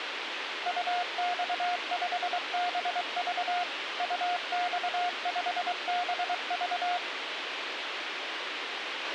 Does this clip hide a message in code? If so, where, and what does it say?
Yes: Morse code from 0.6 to 7.0 s, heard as a keyed tone, machine-sent, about 23 wpm, 710 Hz, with radio hiss and a squelch burst at the end. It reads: UX5BV UX5BV